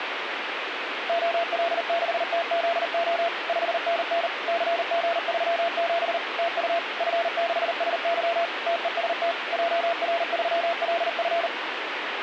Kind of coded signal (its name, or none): Morse code